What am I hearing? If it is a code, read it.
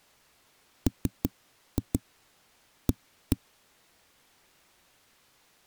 Tap code, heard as knocks on a wall, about 6 knocks a second. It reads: MA